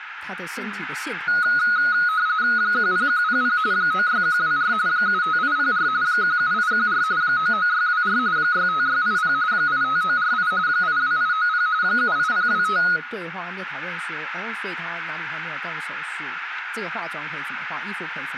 RTTY (45.45 baud, 170 Hz shift), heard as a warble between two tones, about 1360 Hz centre, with radio static, room echo and speech in Chinese. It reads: 10100 96124 75804 17814 99624 65680 85948 82890 78025